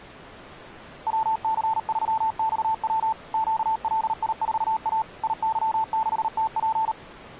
Morse code, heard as a keyed tone, machine-sent, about 38 wpm, 880 Hz. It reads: WC3XW QLI4A IY6TP